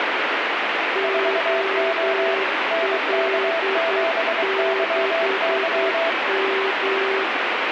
Morse code, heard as two keyed tones, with heavy radio static. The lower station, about 9 wpm, 390 Hz: OL6M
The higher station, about 23 wpm, 660 Hz: 4O NK7YY